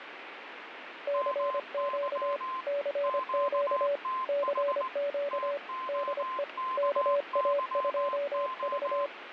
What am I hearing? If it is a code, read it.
Morse code, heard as two keyed tones, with radio static. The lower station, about 25 wpm, 570 Hz: CQ CQ CQ DE KA2V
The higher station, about 19 wpm, 1040 Hz: MY QTH TOKYO